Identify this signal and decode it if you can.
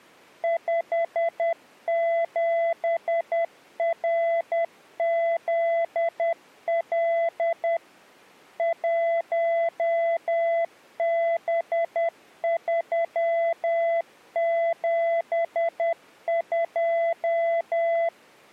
Morse code, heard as a keyed tone, machine-sent, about 10 wpm, 670 Hz. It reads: 57RZL 1B372